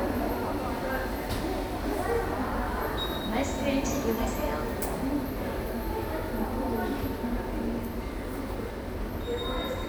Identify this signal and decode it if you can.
The noise of a subway station. There is no code.